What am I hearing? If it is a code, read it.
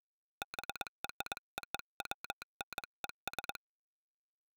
Morse code (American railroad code), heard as a telegraph sounder. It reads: BROWNES